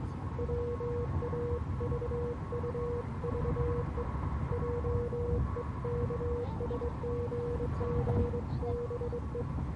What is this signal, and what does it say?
Morse code (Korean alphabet), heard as a keyed tone, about 22 wpm, 480 Hz, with the noise inside a car. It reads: 보리라 하였다